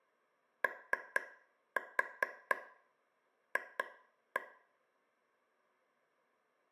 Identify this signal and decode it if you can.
Tap code, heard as taps on a table, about 4 knocks a second, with room echo. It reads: OF